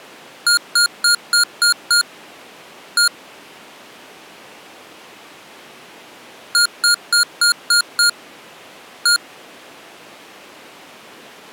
Beep code, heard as beeps from a small speaker, played twice, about 1420 Hz. 6-1.